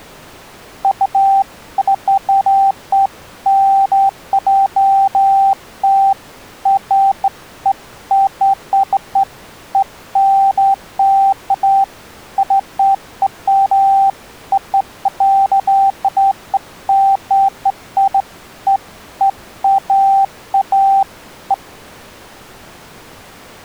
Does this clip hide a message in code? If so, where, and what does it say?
No, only beeps of irregular length.